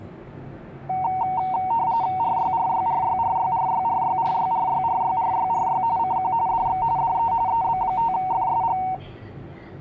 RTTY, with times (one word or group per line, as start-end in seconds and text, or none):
2.2-5.8 RYRYRYRYRYRYRYRYRYRYRY
6.0-6.3 CQ
6.5-6.8 DX
7.0-7.3 DE
7.5-8.8 EB5FSG